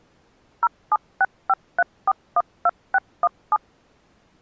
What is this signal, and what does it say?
DTMF, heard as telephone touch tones, dialled by machine, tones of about 40 ms. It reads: 07653412617